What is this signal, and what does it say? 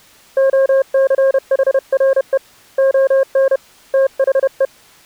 Morse code, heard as a keyed tone, hand-sent with a paddle, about 31 wpm, 540 Hz. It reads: OCHRE ON THE